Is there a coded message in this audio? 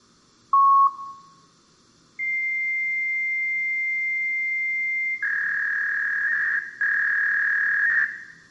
Yes: fax machine handshake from 0.5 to 8.0 s, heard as a long tone and a warble, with room echo.